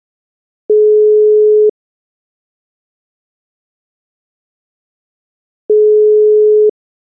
Telephone call progress tone (single-tone plan, as in most of Europe), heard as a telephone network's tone, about 420 Hz, 1 s on and 4 s off. Ringback tone.